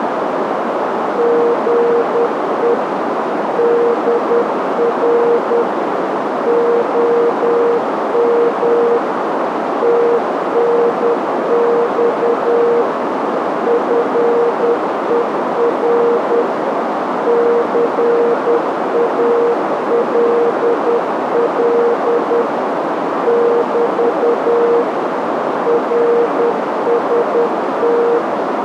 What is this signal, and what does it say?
Morse code, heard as a keyed tone, machine-sent, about 10 wpm, 470 Hz, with heavy radio static and a narrow filter. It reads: GE DR OM TNX FER CALL <BT> RST